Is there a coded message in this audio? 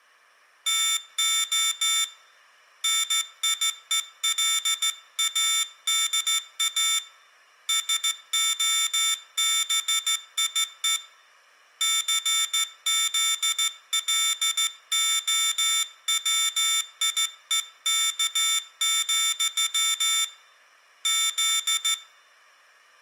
Yes: Morse code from 0.6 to 22.0 s, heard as a high beeper, hand-sent with a straight key, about 14 wpm, 3550 Hz, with room echo. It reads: TO NIELADA SOBIE CZLOWIEK, Z